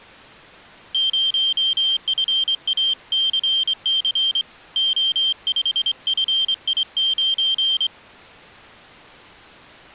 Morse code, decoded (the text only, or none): 0FACC O5FI9